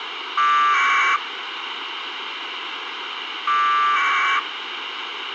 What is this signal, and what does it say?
Packet radio (AX.25, as in APRS), 1200 baud, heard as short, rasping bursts, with radio hiss.